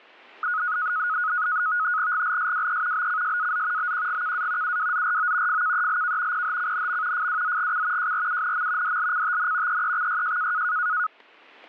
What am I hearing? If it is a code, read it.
NAVTEX (SITOR-B), 100 baud, 170 Hz shift, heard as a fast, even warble, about 1360 Hz centre, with static crashes. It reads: GLSWE BCSAZ BQGKA UWZRO FKELK PHCNM FWZGC JRUNM DLCTN EEXYJ